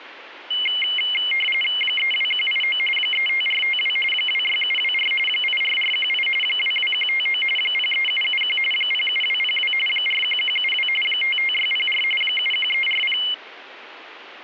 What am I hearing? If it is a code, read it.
RTTY (45.45 baud, 850 Hz shift), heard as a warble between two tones, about 2550 Hz centre. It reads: 32189 35452 26724 84418 22159 03771 07202 41172 55604 71340